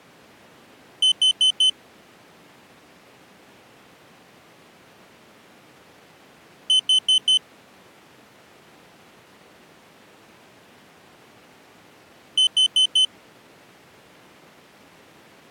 Alarm pattern, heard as an alarm's beeps, played three times, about 3050 Hz. Temporal four. Carbon monoxide.